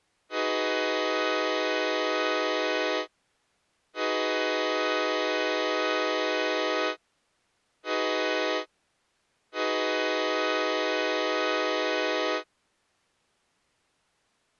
Train horn signal, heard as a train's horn. 2 long, 1 short, 1 long. On North American railways: approaching a public crossing.